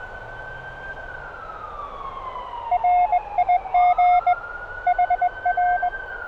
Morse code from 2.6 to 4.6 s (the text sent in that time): RIG